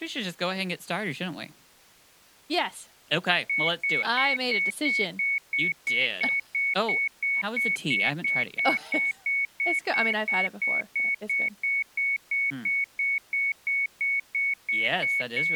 Evenly repeated beeps, with speech in English. There is no code.